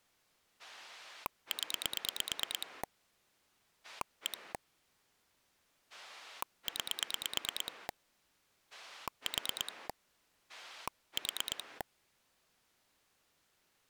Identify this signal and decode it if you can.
Pulse dialling, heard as a rotary dial, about 9 pulses a second. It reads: 0 1 9 4 4